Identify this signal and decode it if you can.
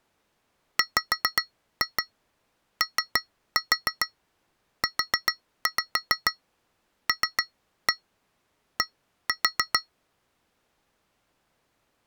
Tap code, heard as taps on glass, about 7 knocks a second. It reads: WOULD